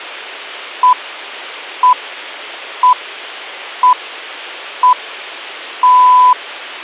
Radio time signal (six pips, as the Greenwich Time Signal), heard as pips.